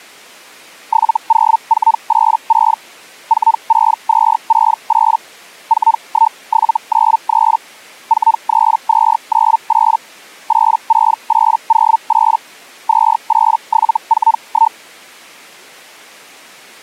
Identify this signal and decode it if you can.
Hellschreiber (Feld-Hell, 122.5 baud), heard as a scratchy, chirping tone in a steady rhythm, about 900 Hz. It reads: 70486 46268 41793 43298 86808 28741